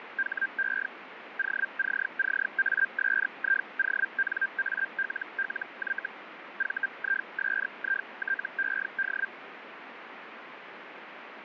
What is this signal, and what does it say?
Hellschreiber (Feld-Hell, 122.5 baud), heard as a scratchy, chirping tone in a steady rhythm, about 1600 Hz, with radio static. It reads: HE OCCASIONALLY VISITED